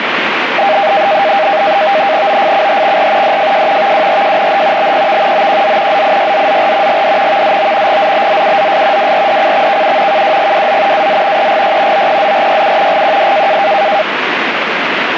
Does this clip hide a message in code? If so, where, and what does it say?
Yes: NAVTEX (SITOR-B), 100 baud, 170 Hz shift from 0.6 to 14.0 s, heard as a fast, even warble, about 710 Hz centre, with radio static. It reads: OFCHXR DFJ VWRJNH BPV OQZ ZIYZZR GD VZO GZBZUZS WRDCXKU KWGWZ AZ EGY OPZRYU GQD